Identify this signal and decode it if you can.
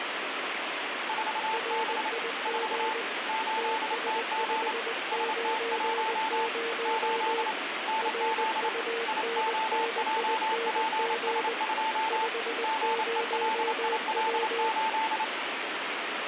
Morse code, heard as two keyed tones, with heavy radio static. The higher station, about 28 wpm, 880 Hz: 4B 4 8TG ST1 8 NZ IOJPS2 GELIL8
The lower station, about 20 wpm, 460 Hz: RIG TS590 RUNNING 50W